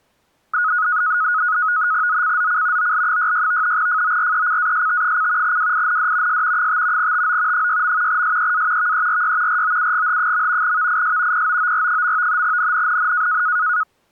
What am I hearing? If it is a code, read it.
NAVTEX (SITOR-B), 100 baud, 170 Hz shift, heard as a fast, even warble, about 1360 Hz centre. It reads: ZCZC OL66 FORECAST: WIND S 5 TO 6. SEA VERY ROUGH. VIS POOR. NNNN